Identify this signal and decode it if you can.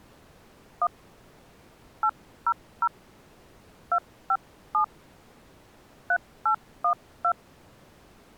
DTMF, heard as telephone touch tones, dialled by hand, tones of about 80 ms. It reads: 1 800 257 3812